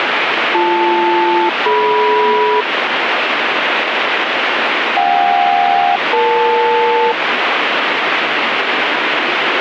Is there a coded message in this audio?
Yes: aircraft SELCAL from 0.5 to 7.1 s, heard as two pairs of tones, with radio static and the noise inside a subway train. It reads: BL-DM JK-EL